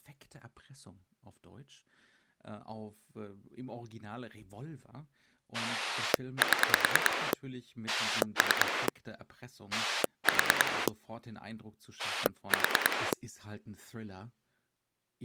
Pulse dialling, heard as a rotary dial, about 9 pulses a second, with speech in German. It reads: 7 3 4 4